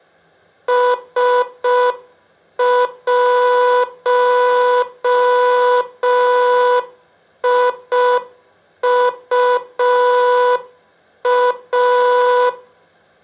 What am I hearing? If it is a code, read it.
Morse code, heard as a buzzer, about 5 wpm, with room echo. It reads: S1IUA